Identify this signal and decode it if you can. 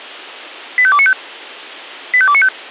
Five-tone selective call (ZVEI), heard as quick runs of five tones, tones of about 70 ms. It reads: 85295 85295